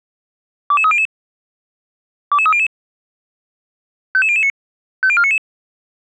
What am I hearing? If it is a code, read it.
Five-tone selective call (ZVEI), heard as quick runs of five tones, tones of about 70 ms. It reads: 22300 22300 55009 50499